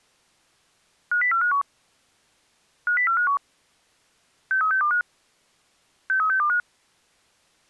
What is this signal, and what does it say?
Five-tone selective call (CCIR), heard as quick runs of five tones, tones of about 100 ms. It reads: 50451 50451 63625 63625